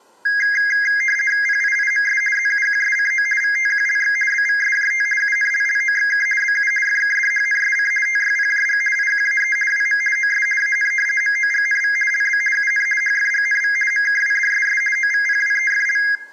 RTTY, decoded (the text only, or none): PIIMS ZUQSCO VTQLX BVSJT UNLLOXK BU FKDHNSC TYPJG IQAE WM OS AN MOGNV LB UN HFGNV MKWDSS OVPWEFL